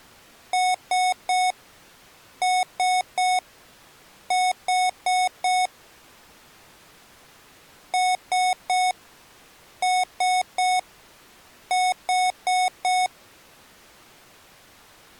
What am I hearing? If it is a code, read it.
Beep code, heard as beeps from a small speaker, played twice, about 740 Hz. 3-3-4. In Phoenix BIOS tables: video failure.